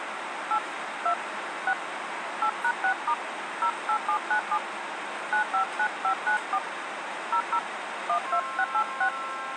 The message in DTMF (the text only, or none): 8 2 6 8#6* 08797 959594 00 12686